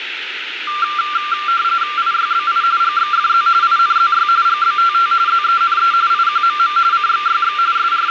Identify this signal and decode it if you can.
RTTY (45.45 baud, 170 Hz shift), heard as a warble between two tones, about 1280 Hz centre, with radio static and room echo. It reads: IYBI GXFZ INZY GBTT ZENE IQMM CXYX …